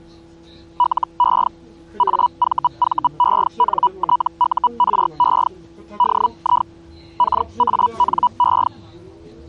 Hellschreiber (Feld-Hell, 122.5 baud), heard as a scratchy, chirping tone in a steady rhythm, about 980 Hz, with the noise inside a bus. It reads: LE AVVENTURE DI KANE